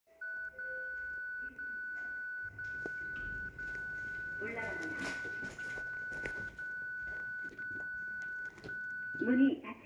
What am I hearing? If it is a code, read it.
Radio time signal (DCF77), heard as a tone whose level steps once a second, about 1490 Hz, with the noise inside a lift. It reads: 0 0 0 0 0 0 0 0 1